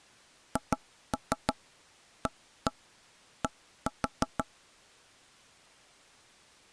Tap code, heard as knocks on wood, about 6 knocks a second. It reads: HAD